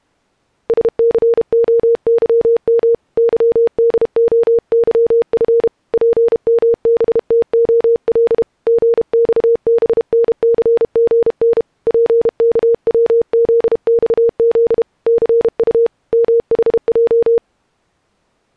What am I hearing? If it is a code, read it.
Morse code, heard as a keyed tone, hand-sent with a paddle, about 32 wpm, 470 Hz. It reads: SCOYM YDOYF PMBTOL GXBNCGN PKWZXZ CU MHJ